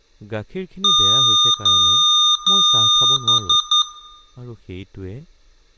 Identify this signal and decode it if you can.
Beep code, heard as beeps from a small speaker, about 1220 Hz, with room echo and speech in Assamese. 3 long, 3 short.